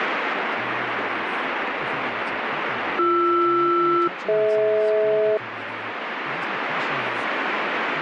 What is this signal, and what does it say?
Aircraft SELCAL, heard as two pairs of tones, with radio static and speech in English. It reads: BR-DH